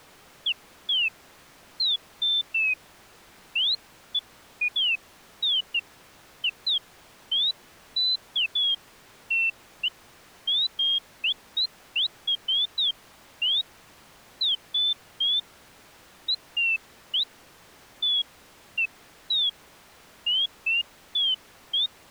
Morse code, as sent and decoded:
none

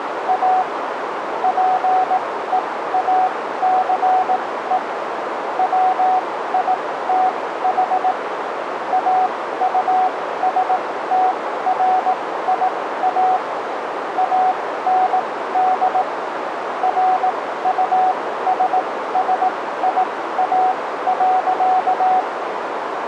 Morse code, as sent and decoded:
.- / .--. . .- -.-. . / .-- .. - .... / .- ..- ... - .-. .. .- / .- -. -.. / .-. ..- ... ... .. .- .-.-.-
A PEACE WITH AUSTRIA AND RUSSIA.

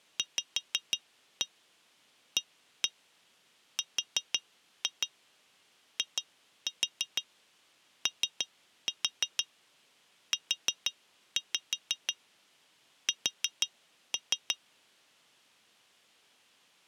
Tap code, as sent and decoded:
5-1 1-1 4-2 2-4 3-4 4-5 4-3
VARIOUS

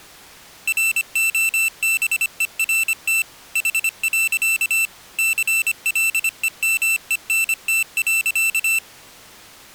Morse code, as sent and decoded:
.-. --- -... . .-. - / .... .-.-.- / -.-. .-.. . -- . -. - .-.-.-
ROBERT H. CLEMENT.

